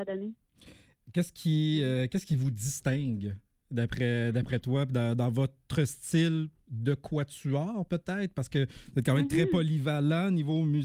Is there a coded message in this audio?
No.